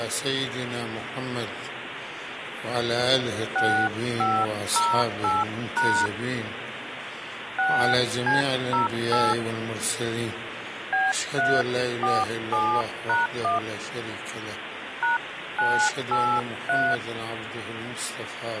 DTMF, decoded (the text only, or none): 6508# 6C08 B347#1 #983